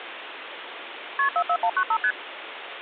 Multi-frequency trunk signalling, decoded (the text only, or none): KP 44195 ST